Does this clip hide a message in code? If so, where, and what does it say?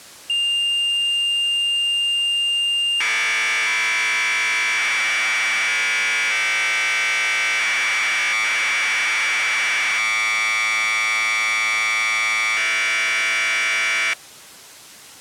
Yes: Commodore tape loading (standard loader) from 0.3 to 14.1 s, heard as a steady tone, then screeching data.